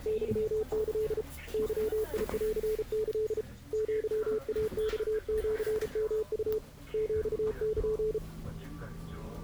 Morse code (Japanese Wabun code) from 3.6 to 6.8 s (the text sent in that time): アイマシヨウ